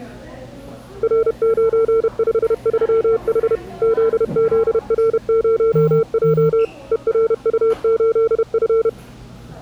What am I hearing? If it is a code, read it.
Morse code, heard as a keyed tone, machine-sent, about 31 wpm, 450 Hz, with the noise of a cafe. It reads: R953H ZZR0J ERU8F